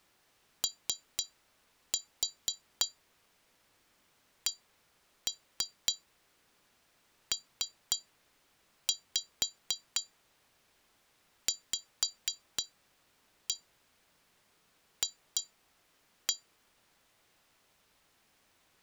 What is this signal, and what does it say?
Tap code, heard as taps on glass, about 3 knocks a second. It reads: OCPVF